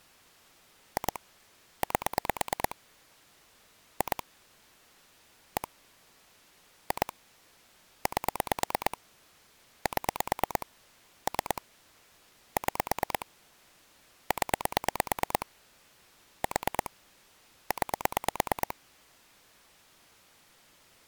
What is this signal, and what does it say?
Pulse dialling, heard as clicks on a phone line, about 9 pulses a second. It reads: 2 8 2 1 2 8 7 3 6 0 4 9